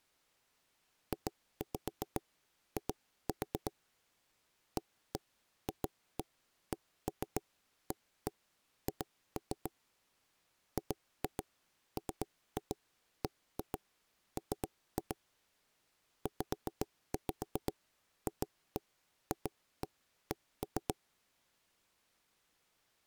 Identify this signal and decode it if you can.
Tap code, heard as knocks on wood, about 7 knocks a second. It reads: JI AFCAH GMBM ZFFC